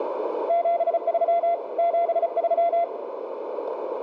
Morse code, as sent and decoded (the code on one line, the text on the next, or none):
--... ...-- / --... ...--
73 73